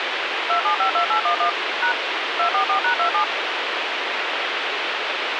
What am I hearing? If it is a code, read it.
DTMF, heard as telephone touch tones, dialled by machine, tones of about 100 ms, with radio hiss. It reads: 2752811 # 244#27